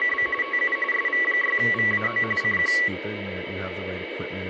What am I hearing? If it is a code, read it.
RTTY (45.45 baud, 850 Hz shift), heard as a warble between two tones, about 1550 Hz centre, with radio static, a steady whistle near 2260 Hz and speech in English. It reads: … TU SV6VAO CQ